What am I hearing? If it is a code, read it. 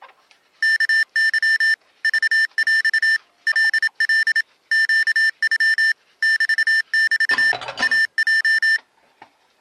Morse code (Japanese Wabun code), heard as electronic beeps, machine-sent, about 27 wpm, 1800 Hz, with kitchen noise. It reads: ワケ クヰ カカ ネノ メメ イヲ